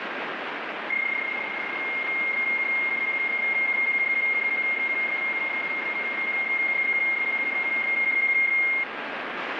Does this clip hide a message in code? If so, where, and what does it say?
Yes: PSK31 (31.25 baud) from 0.9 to 8.8 s, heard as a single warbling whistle, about 2150 Hz, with radio static.